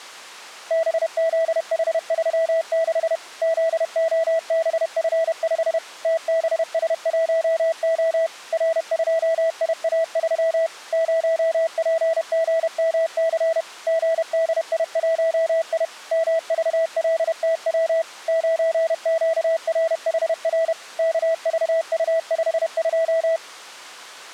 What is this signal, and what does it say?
Morse code, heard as a keyed tone, machine-sent, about 31 wpm, 650 Hz. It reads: BZH36 ZOBF5 TBS1O R2IA3 0PGMC GDI1I MVLTW 9QRHR KVU52